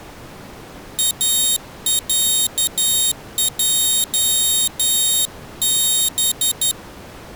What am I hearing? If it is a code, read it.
Morse code (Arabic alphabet), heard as a high beeper, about 11 wpm, 3750 Hz. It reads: اعجب